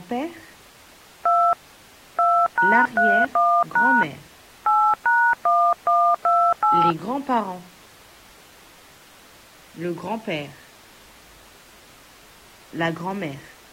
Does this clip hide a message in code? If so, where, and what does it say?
Yes: DTMF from 1.3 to 6.9 s, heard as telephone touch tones, dialled by hand, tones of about 280 ms. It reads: 2 2#31# 8#1128